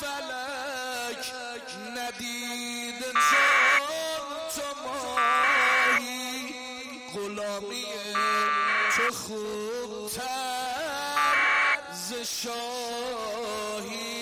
Packet radio (AX.25, as in APRS), 1200 baud, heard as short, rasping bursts.